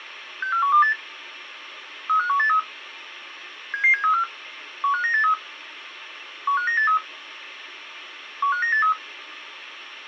Five-tone selective call (CCIR), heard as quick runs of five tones, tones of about 100 ms. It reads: 64128 35183 77734 15983 15983 15983